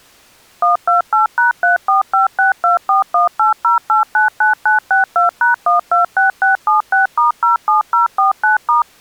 DTMF, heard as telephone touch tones, dialled by machine, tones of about 130 ms. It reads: 128#345624180899962#126676*07049*